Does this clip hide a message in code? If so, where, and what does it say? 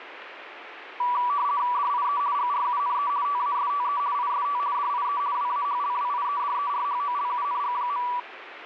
Yes: RTTY (50 baud, 170 Hz shift) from 1.0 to 8.2 s, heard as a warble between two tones, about 1060 Hz centre, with radio static. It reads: DIE GRUNE TASTE IST DIE WAHLWIEDERHOLUNG.